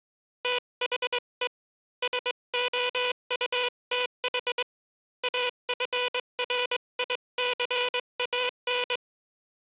Morse code, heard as a buzzer, hand-sent with a straight key, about 21 wpm. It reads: THE SOUTH AFRICAN